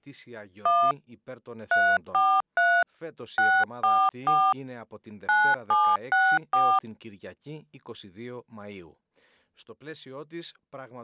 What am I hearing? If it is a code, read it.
DTMF, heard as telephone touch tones, dialled by hand, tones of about 260 ms. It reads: 1 343 644 9764